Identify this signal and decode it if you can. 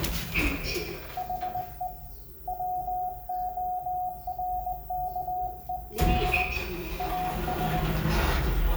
Morse code, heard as a keyed tone, hand-sent with a straight key, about 20 wpm, 730 Hz, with room echo and the noise inside a lift. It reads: HE WORKED AS